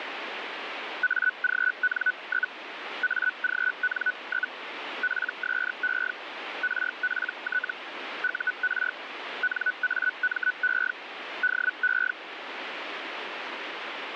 Hellschreiber (Feld-Hell, 122.5 baud), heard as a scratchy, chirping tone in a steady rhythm, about 1490 Hz, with radio static. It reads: AGN? AGN? PSE RPT UR NAME DE